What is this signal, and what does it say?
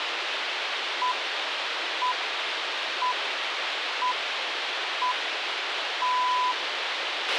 Radio time signal (six pips, as the Greenwich Time Signal), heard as pips, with radio hiss and a squelch burst at the end.